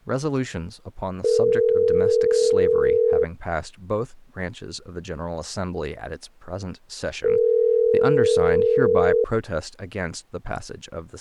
Telephone call progress tone (North American plan), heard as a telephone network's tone, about 440, 480 Hz, 2 s on and 4 s off, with speech in English. Ringback tone.